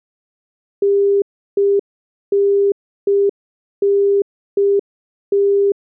Telephone call progress tone (UK plan), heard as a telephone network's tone, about 400 Hz. Congestion tone.